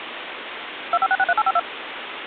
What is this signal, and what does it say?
DTMF, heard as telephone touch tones, dialled by machine, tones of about 50 ms, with phone line noise. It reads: 25663852